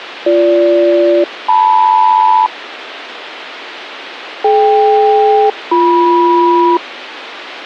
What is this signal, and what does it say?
Aircraft SELCAL, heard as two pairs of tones, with radio hiss and a squelch burst at the end. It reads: BG-LM DK-BM